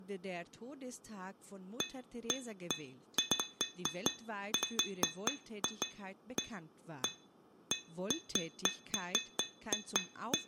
Irregular taps on glass, with room echo and speech in German. There is no code.